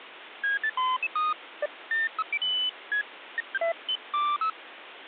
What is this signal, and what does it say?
Electronic bleeps of random pitch and length, with phone line noise. There is no code.